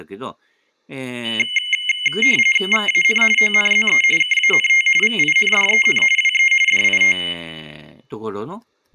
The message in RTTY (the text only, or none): VAN ONZE KANT VINDEN WE DIT